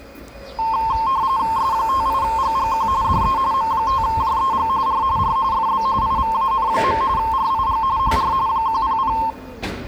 RTTY (45.45 baud, 170 Hz shift), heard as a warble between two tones, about 980 Hz centre, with the noise of a residential street. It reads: S58GGQ DE M5JEG R R FB IVAN. RIG HR 100